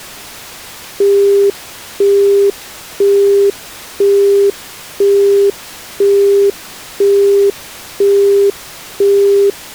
Telephone call progress tone (single-tone plan, as in Europe, Japan and elsewhere), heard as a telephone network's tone, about 400 Hz, 0.5 s on and 0.5 s off. Busy tone.